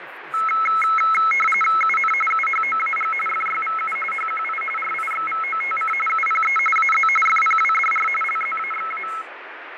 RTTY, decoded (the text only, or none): UN UHOAG FYVU HQI RIXVOTC UPE AZ FPWDR LZAXA